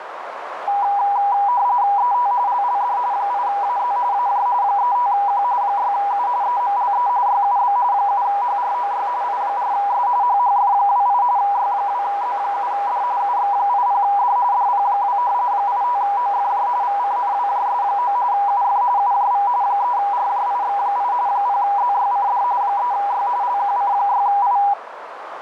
RTTY (45.45 baud, 170 Hz shift), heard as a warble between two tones, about 890 Hz centre, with radio static and a narrow filter. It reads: ET LLD 8AZ AJ 35Q 6U EMLE YUB 7HROY I4S HHF28 Y2Z7D UX80D DP2 85OFJ VCNWJS9 UF UJV 3RJIX8 0ZYCD 3Y LQC6I